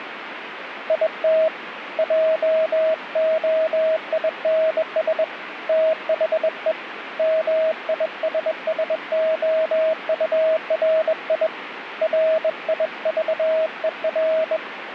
Morse code, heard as a keyed tone, hand-sent with a bug key, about 21 wpm, 640 Hz, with radio static. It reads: IT JOINS THE MISSOURI RIVER